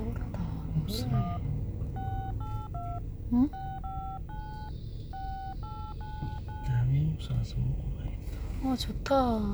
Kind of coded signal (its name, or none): DTMF